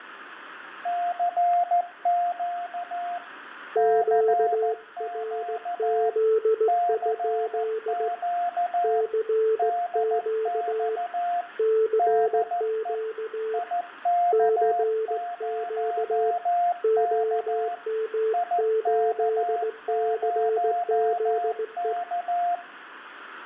Morse code, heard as two keyed tones, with room echo. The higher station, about 14 wpm, 700 Hz: CQ CQ CQ DX DE IK0K IK0K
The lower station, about 17 wpm, 440 Hz: QRZ? CQ CQ CQ OM8CZE